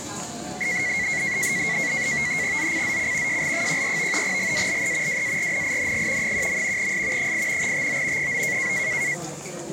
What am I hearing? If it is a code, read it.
NAVTEX (SITOR-B), 100 baud, 170 Hz shift, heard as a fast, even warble, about 2050 Hz centre, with the noise of a crowd indoors. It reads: ZCZC JL14 GALE WARNING 1. S 8 TO 9